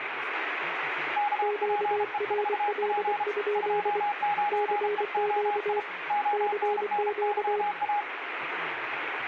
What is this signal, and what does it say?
Morse code, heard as two keyed tones, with radio static and speech in English. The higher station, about 33 wpm, 830 Hz: KPE4P 29EOI ONNYA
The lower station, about 24 wpm, 420 Hz: QRL? CQ CQ